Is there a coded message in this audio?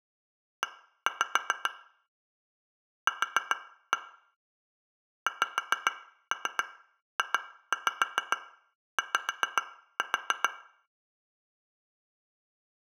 Yes: tap code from 0.6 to 10.5 s, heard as taps on glass, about 7 knocks a second, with room echo. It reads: E Q XJY